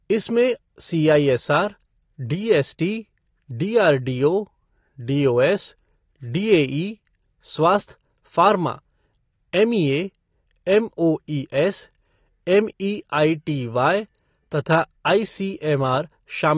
Speech in Hindi. There is no code.